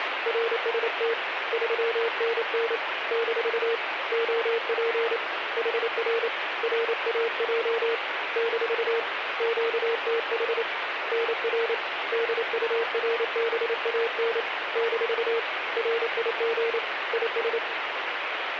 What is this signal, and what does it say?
Morse code, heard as a keyed tone, hand-sent with a paddle, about 28 wpm, 460 Hz, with radio static. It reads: RST 3NN - OP HR RAJ - QTH NR DURBAN - RIG IS